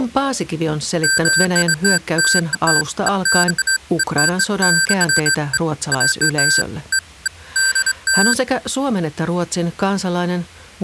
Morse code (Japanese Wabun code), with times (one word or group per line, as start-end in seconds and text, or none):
none